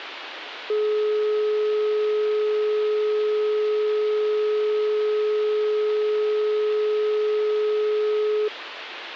Telephone call progress tone (425 Hz plan, as in most of Europe), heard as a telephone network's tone, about 420 Hz, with phone line noise. Dial tone.